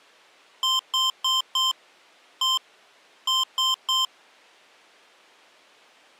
Beep code, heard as beeps from a small speaker, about 1040 Hz. 4-1-3.